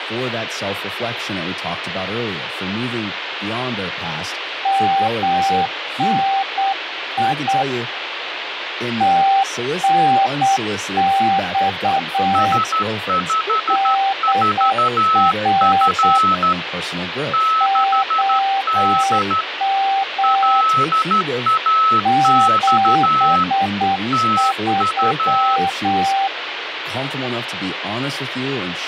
Morse code, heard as two keyed tones, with radio static and speech in English. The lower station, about 8 wpm, 780 Hz: MNI TNX DR OM 73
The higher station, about 13 wpm, 1300 Hz: S54F 6D LAX TU